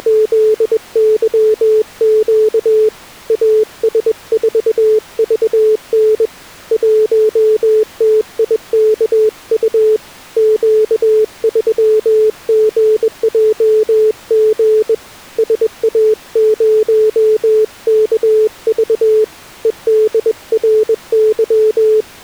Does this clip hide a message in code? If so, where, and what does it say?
Yes: Morse code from 0.0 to 22.2 s, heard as a keyed tone, hand-sent with a bug key, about 21 wpm, 430 Hz. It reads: … AS4VN 1TIKU Q3GJG SA0KV …